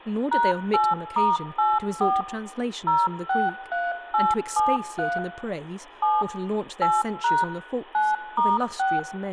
DTMF, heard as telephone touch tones, dialled by machine, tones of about 200 ms, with room echo and speech in English. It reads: #8*84 063873 7 8# 9*6